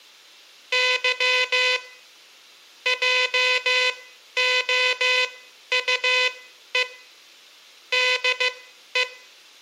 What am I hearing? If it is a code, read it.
Morse code, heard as a buzzer, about 15 wpm, spaced as for 11 wpm. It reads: Y JOUE DE